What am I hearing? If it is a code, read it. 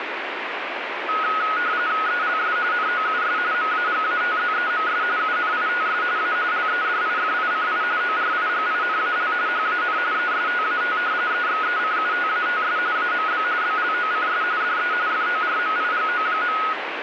RTTY (45.45 baud, 170 Hz shift), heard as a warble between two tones, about 1360 Hz centre, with radio static. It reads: ELS NOUS MAGATZEMS UNITS A LEDIFICI ORIGINAL HAN ESTAT EXECUTATS AMB BLOCS DE FORMIGO.